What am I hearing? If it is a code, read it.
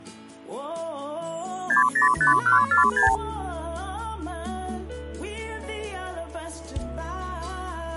Multi-frequency trunk signalling (R2, with the far end's replies), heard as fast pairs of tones, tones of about 130 ms. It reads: 605146